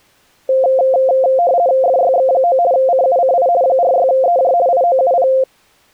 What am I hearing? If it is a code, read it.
RTTY (50 baud, 170 Hz shift), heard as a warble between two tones, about 610 Hz centre. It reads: FYX9 CUCI 46EJ IOUP